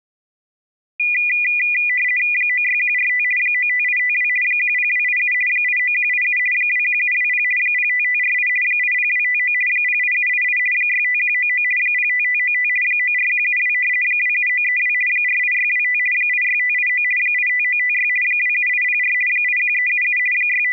RTTY (50 baud, 450 Hz shift), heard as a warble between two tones, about 2200 Hz centre. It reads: 96145 95852 10287 89187 21720 05548 80259 08788 65199 05595 94172 27932 48625 86589 85956 27804 81377 …